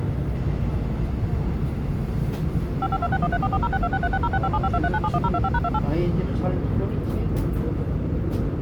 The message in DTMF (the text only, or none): 552613440626360657523971025#28